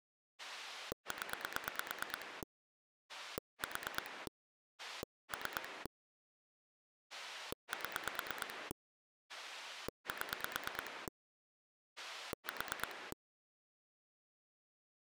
Pulse dialling, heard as a rotary dial, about 9 pulses a second. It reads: 0 4 3 7 7 4